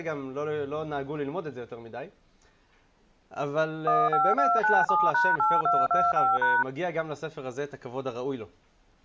DTMF, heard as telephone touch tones, dialled by machine, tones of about 210 ms. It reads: 15297#8225#